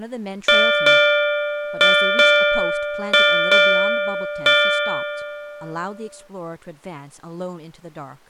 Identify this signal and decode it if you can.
Ship's bell, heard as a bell, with speech in English. 7. Seven half-hours of the watch have passed.